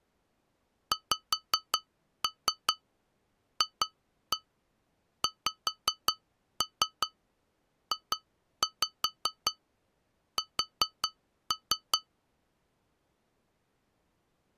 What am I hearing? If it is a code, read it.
Tap code, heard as taps on glass, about 5 knocks a second. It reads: XFXJS